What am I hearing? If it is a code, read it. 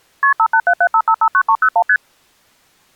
Multi-frequency trunk signalling (R1, as on North American trunks), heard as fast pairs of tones, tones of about 70 ms. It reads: KP 58775559301 ST